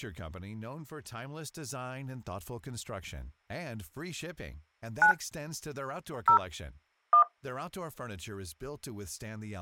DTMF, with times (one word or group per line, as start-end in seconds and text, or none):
5.0-5.1 9
6.3-6.4 0
7.1-7.2 1